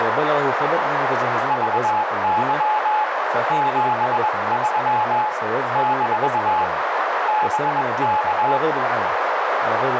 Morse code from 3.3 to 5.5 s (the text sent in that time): 73